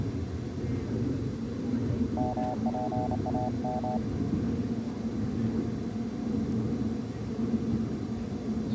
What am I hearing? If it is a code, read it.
Morse code (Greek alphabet), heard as a keyed tone, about 29 wpm, 750 Hz, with the noise inside a subway train. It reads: ΜΠΑΜ